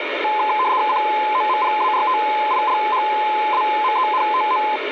RTTY (75 baud, 170 Hz shift), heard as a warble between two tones, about 940 Hz centre, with radio static. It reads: COMPARTILHAMENTO